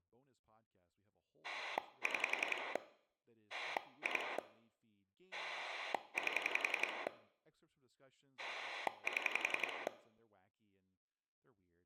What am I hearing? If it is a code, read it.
Pulse dialling, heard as a rotary dial, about 11 pulses a second, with room echo and speech in English. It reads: 6 2 8 7